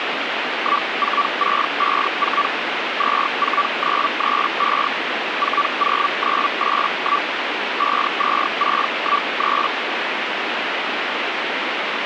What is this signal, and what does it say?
Hellschreiber (Feld-Hell, 122.5 baud), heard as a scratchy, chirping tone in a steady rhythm, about 1160 Hz, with radio static. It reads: 14654 24935 40981 52613